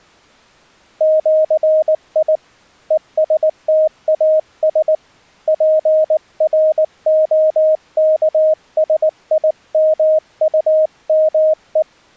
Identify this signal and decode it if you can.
Morse code (with Esperanto letters), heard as a keyed tone, hand-sent with a paddle, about 19 wpm, 620 Hz. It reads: ĜI ESTAS PROKSIMUME